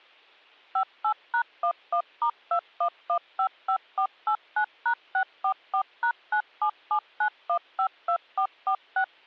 DTMF, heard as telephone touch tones, dialled by machine, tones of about 80 ms. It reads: 58#11*21155489#644#9779152446